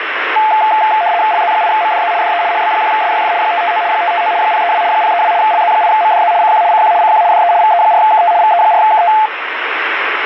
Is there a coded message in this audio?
Yes: RTTY (75 baud, 170 Hz shift) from 0.4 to 9.3 s, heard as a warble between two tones, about 780 Hz centre, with radio static. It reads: LZ8MDZ DE HB1SYF 559 559 032 032 LZ8MDZ CQ CQ CQ DE VE4KT VE4KT